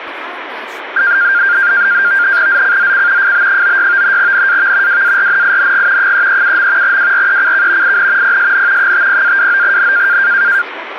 NAVTEX (SITOR-B), 100 baud, 170 Hz shift, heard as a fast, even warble, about 1500 Hz centre, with radio static and speech in Manipuri. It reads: ZCZC FB96 NAV WARNING 337. WRECK IN PSN 50-29N